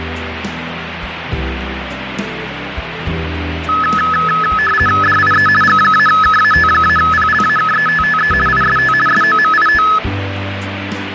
RTTY (50 baud, 450 Hz shift), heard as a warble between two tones, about 1500 Hz centre, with radio static. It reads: DIE G-KAT-PLAKETTE IST SOMIT